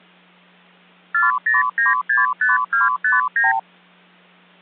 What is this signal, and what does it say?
Multi-frequency trunk signalling (R2, with the far end's replies), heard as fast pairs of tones, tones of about 160 ms. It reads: 40965259